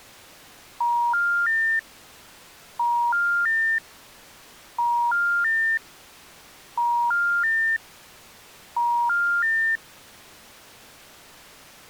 Telephone call progress tone (ITU plan), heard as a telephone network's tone, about 950, 1400, 1800 Hz. Special information tone.